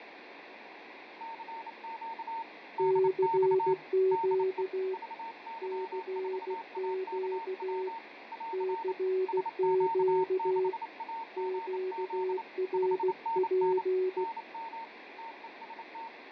Morse code, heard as two keyed tones, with radio static, fading and room echo. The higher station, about 28 wpm, 910 Hz: CQ DX DE VY4AKW <AR> SQ6AGZ 5NN NM TEST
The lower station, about 16 wpm, 380 Hz: CQ CQ CQ QRP